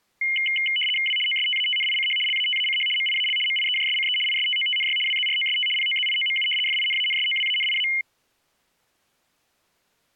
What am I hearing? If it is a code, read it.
RTTY (75 baud, 850 Hz shift), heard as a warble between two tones, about 2550 Hz centre. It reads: W OSTATNICH LATACH MIAL MIEJSCE ISTOTNY WZROST POZIOMU FINANSOWANIA